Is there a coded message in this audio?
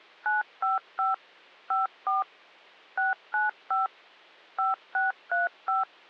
Yes: DTMF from 0.3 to 5.8 s, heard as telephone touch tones, dialled by machine, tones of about 160 ms. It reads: 955 54 695 5635